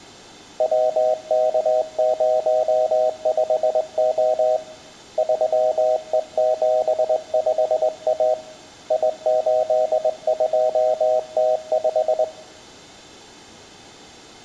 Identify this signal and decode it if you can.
Morse code, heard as a keyed tone, hand-sent with a straight key, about 20 wpm, 630 Hz, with room echo. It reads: WK05O 3E75A I82T5